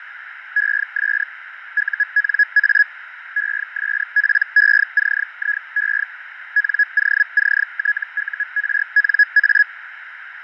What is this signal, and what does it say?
Hellschreiber (Feld-Hell, 122.5 baud), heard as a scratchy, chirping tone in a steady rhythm, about 1700 Hz, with radio static, fading and a narrow filter. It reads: ES UNA ESPECIE NOCTURNA